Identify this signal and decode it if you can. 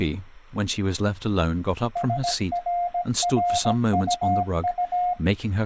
Morse code, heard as a keyed tone, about 17 wpm, 710 Hz, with speech in English. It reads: SRRUU